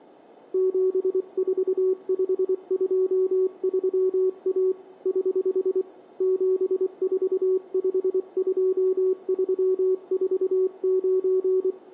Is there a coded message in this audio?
Yes: Morse code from 0.5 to 11.8 s, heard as a keyed tone, hand-sent with a paddle, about 24 wpm, 370 Hz, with room echo. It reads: 74523A <HH> 7452349